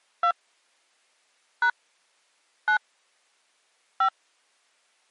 DTMF, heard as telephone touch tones, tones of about 90 ms. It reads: 2 # 9 5